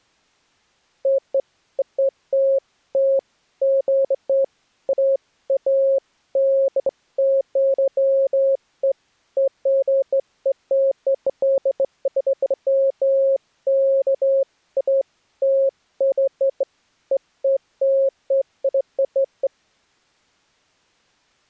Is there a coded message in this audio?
No, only beeps of irregular length.